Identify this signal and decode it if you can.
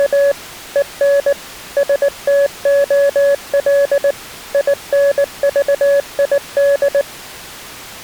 Morse code, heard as a keyed tone, machine-sent, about 19 wpm, 560 Hz. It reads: … EN STOL INVID